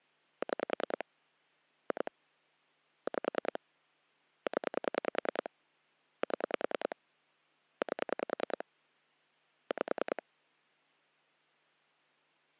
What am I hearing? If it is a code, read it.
Pulse dialling, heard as clicks on a phone line, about 10 pulses a second. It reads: 6 2 5 0 7 8 5